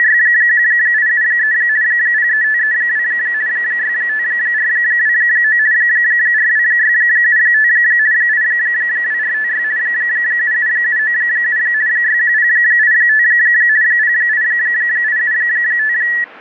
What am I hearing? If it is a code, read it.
RTTY (50 baud, 170 Hz shift), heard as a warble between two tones, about 1800 Hz centre. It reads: … 03532 65429 42675 82456 77797 61085 08875